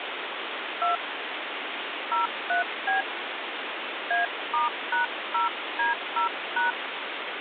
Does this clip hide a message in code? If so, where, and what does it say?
Yes: DTMF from 0.8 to 6.7 s, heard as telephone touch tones, dialled by hand, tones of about 130 ms, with phone line noise. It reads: 2 03B A*#0D0#